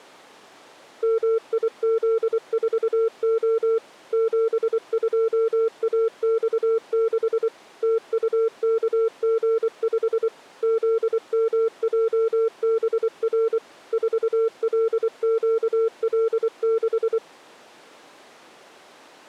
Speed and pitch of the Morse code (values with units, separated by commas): 24 wpm, 450 Hz